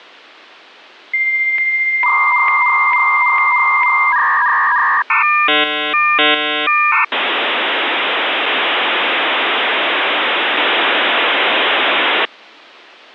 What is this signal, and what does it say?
Dial-up modem handshake (V.34 or later), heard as a whistle, warbles, then hiss.